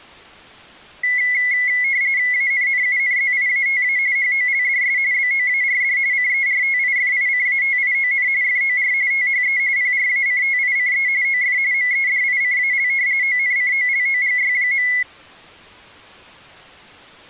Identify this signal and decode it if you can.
RTTY (45.45 baud, 170 Hz shift), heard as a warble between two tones, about 2050 Hz centre. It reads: ANNUNZIATA HOLDS BOARD CERTIFICATION FOR THE PRACTICE OF MEDICAL ONCOLOGY.